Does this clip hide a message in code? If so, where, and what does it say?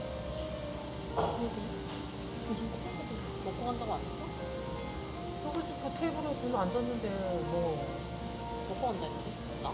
No, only the noise of a cafe.